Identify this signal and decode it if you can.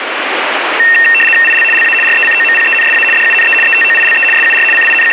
RTTY (75 baud, 850 Hz shift), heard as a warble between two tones, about 2250 Hz centre, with radio static. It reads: IL LA RECOMPENSA DUNE ETOILE SUR …